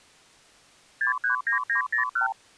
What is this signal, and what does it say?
Multi-frequency trunk signalling (R2, with the far end's replies), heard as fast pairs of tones, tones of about 110 ms. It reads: 639901